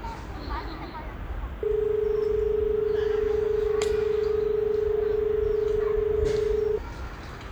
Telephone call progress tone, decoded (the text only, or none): dial tone